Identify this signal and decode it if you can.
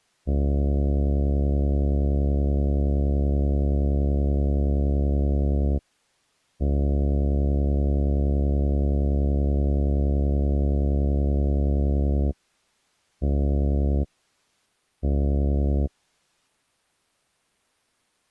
Ship horn signal, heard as a ship's horn, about 70 Hz. 2 long, 2 short. At sea: I intend to overtake on your port side.